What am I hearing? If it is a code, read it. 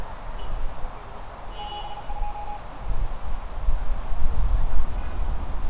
Morse code, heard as a keyed tone, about 38 wpm, 830 Hz, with radio static, a narrow filter and street noise. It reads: 72